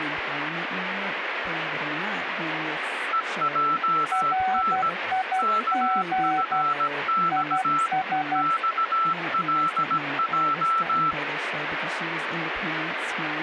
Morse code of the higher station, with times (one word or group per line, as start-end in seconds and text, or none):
3.1-4.9 EJN
5.4-7.9 KFX
8.4-11.1 XLJ